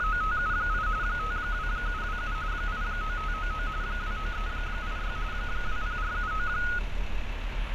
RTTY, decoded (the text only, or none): … 52727 89599 29386 20479